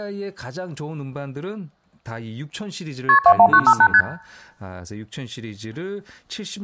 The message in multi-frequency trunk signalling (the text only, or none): KP 21958 ST